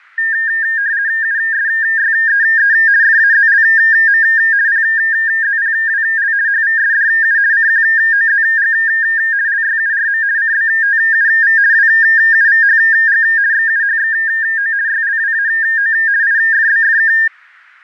RTTY (50 baud, 170 Hz shift), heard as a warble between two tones, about 1700 Hz centre. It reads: USYEE FAZLM PZPWL HVSDU CQOZG LYURM CBTUV WUVHG XUHXO YLWAO IFBFK